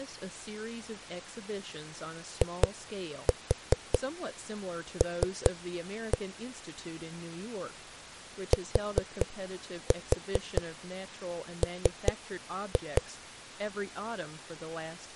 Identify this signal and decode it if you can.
Tap code, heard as knocks on a wall, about 4 knocks a second, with speech in English. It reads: IL TM